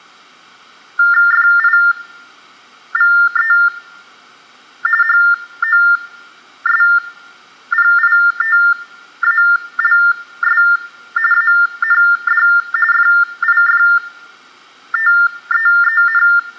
TTY/TDD text telephone tones (45.45 baud Baudot), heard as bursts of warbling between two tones, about 400 Hz shift, 1600 Hz centre. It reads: FIVE HOSPITALS AND FIFTEEN